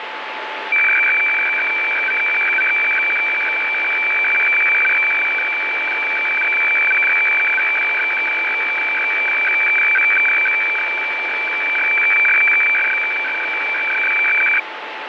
Weather fax (radiofax), 120 lines a minute, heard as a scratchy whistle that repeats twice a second, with radio static.